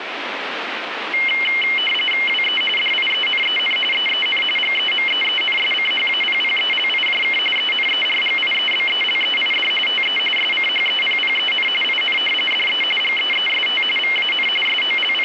RTTY (45.45 baud, 850 Hz shift), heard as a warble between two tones, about 2550 Hz centre, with radio static. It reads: WE DIENEN EEN GEMEENSCHAPPELIJK ENERGIEBELEID TE SCHEPPEN IN DE GEEST VAN …